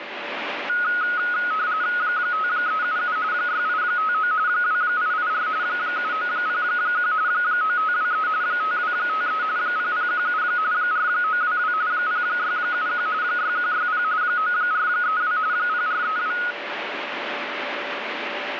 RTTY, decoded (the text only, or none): 5377 6859 2884 7901 9523 5253 0017 4922 0671 6160 9432 0432